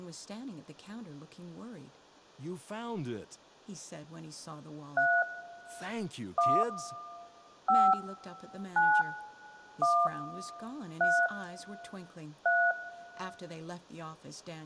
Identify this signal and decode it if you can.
DTMF, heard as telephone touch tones, dialled by hand, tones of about 260 ms, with room echo and speech in English. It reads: 3 1 5 9 1 3 3